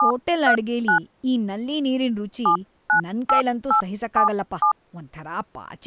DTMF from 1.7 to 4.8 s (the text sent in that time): 798877